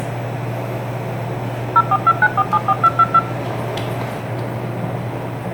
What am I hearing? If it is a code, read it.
DTMF, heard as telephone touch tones, dialled by machine, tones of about 50 ms, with room echo and the noise inside a lift. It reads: 0429474222